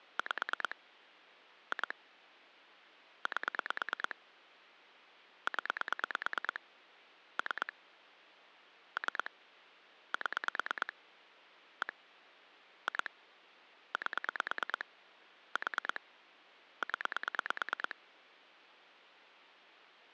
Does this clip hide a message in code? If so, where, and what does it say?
Yes: pulse dialling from 0.2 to 17.9 s, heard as clicks on a phone line, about 9 pulses a second. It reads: 5 2 8 0 3 3 7 1 2 8 4 0